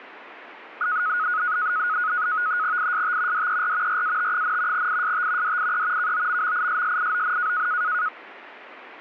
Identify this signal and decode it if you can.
NAVTEX (SITOR-B), 100 baud, 170 Hz shift, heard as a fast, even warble, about 1360 Hz centre. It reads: IST DER RAT, IST DIE KOMMISSION